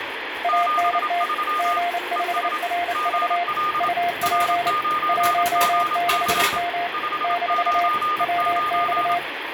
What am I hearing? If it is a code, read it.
Morse code, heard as two keyed tones, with radio static and kitchen noise. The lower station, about 29 wpm, 700 Hz: ANT G5RV UP 16M - WX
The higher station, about 27 wpm, 1220 Hz: 73 ES GL R9GC 599